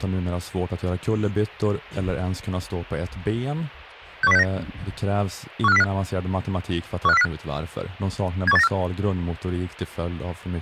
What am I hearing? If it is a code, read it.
Five-tone selective call (EEA), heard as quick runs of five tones, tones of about 40 ms, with speech in Swedish. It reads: 61069 15405 15405 71894